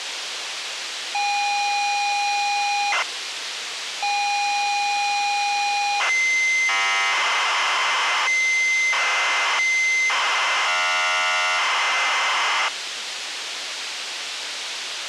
ZX Spectrum tape loading, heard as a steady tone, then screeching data, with tape hiss.